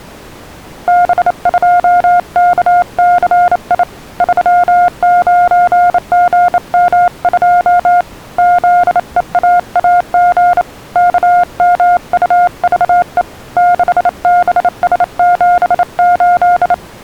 Morse code, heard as a keyed tone, hand-sent with a bug key, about 28 wpm, 710 Hz. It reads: B2KCI 39GM2 ZEAAG KMUVE 6BS78